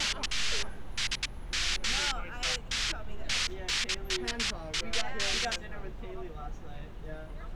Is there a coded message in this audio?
No, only bursts of noise, with street noise.